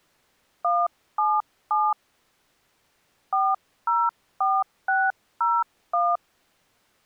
DTMF, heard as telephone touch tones, dialled by hand, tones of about 220 ms. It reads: 177 404601